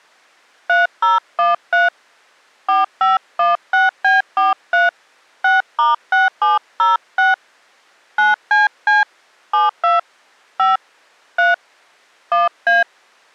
DTMF, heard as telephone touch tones, dialled by hand, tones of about 160 ms. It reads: 3013 4516B43 6*6706 9CC 72 5 3 1A